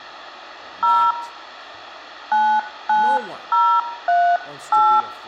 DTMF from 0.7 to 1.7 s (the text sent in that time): 0